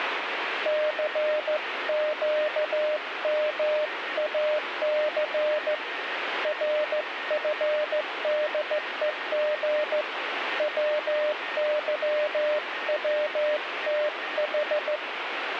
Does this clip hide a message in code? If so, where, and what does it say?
Yes: Morse code (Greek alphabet) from 0.6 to 15.0 s, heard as a keyed tone, hand-sent with a straight key, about 15 wpm, 600 Hz, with radio static and a weaker station near 1850 Hz. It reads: ΘΨΜΑΘ ΡΦΔΕΓ ΩΥΩΤΗ